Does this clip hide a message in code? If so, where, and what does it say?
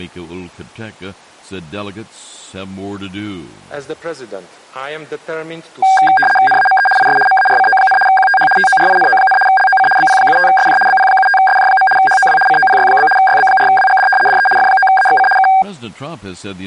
Yes: RTTY (75 baud, 850 Hz shift) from 5.8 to 15.6 s, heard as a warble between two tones, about 1190 Hz centre. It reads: NAME IS MARCO, QTH TORINO, LOC BP75SJ BP75SJ. HOW COPY? YB4WGD DE F9AXC K